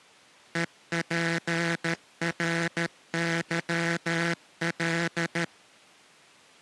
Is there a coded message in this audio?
Yes: Morse code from 0.5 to 5.5 s, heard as a buzzer, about 13 wpm. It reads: EPRYL